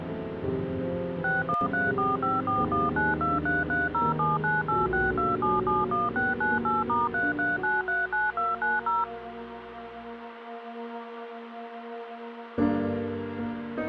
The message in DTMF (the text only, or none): 61345419233079862771698*33939290